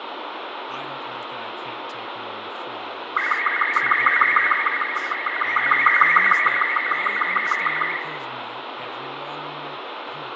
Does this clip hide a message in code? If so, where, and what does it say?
Yes: SSTV (slow-scan television), Robot 36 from 3.2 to 8.0 s, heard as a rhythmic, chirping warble, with radio static, fading, room echo and speech in English.